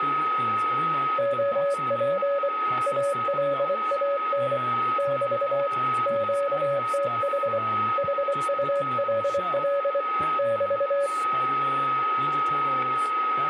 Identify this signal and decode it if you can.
Morse code, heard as a keyed tone, hand-sent with a bug key, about 24 wpm, 560 Hz, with a steady whistle near 1270 Hz, room echo and speech in English. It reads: OP ALAN <BT> QTH HULL <BT>